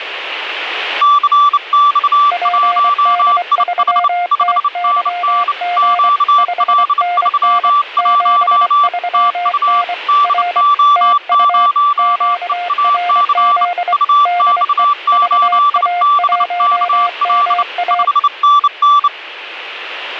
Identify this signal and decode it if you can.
Morse code, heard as two keyed tones, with radio static. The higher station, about 29 wpm, 1160 Hz: CX1IH 5NN QL31 TU DO0EAC UX8BKL 5NN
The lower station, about 24 wpm, 710 Hz: PD3TYG 5NN 73N R TU QRZ DE VA1MA